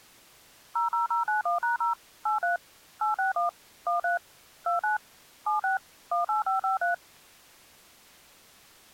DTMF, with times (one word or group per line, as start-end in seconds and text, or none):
0.8-1.9 00091#0
2.3-2.6 83
3.0-3.5 861
3.9-4.2 13
4.7-5.0 29
5.5-5.8 76
6.1-6.9 18553